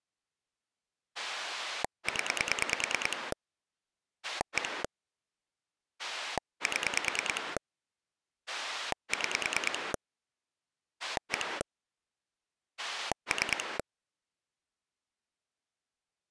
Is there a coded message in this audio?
Yes: pulse dialling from 1.2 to 13.8 s, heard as a rotary dial, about 9 pulses a second. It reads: 0 1 7 6 1 3